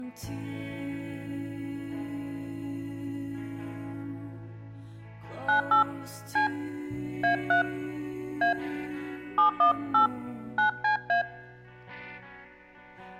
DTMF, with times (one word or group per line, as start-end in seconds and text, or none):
5.5-5.8 98
6.4-6.5 C
7.2-7.6 A3
8.4-8.5 A
9.4-10.1 718
10.6-11.2 9CA